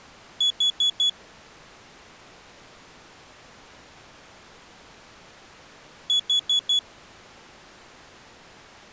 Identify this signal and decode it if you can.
Alarm pattern, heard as an alarm's beeps, played twice, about 3400 Hz. Temporal four. Carbon monoxide.